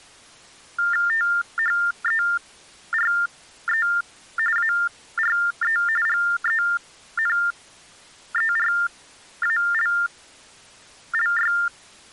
TTY/TDD text telephone tones (45.45 baud Baudot), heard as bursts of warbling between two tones, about 400 Hz shift, 1600 Hz centre. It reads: THERE ARE GENERALLY